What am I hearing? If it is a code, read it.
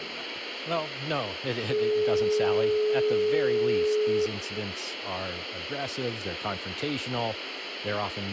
Telephone call progress tone (425 Hz plan, as in most of Europe), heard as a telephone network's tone, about 420 Hz, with phone line noise, room echo and speech in English. Dial tone.